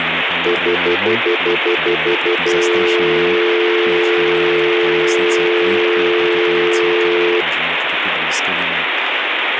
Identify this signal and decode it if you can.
Telephone call progress tone (North American plan), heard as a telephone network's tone, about 350, 440 Hz, 0.1 s on and 0.1 s off, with phone line noise and speech in Slovak. Stutter dial tone.